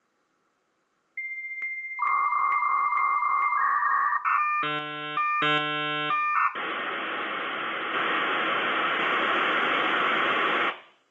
Dial-up modem handshake (V.34 or later), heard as a whistle, warbles, then hiss, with room echo.